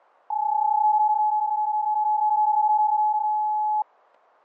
PSK31 (31.25 baud), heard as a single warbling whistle, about 850 Hz.